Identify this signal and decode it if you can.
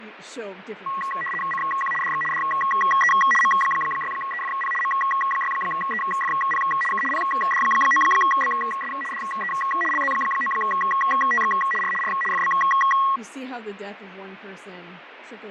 RTTY (75 baud, 850 Hz shift), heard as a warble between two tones, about 1500 Hz centre, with radio static, fading and speech in English. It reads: CQ DX DE M6EFP M6EFP K PD9BS DE LZ9TX R R FB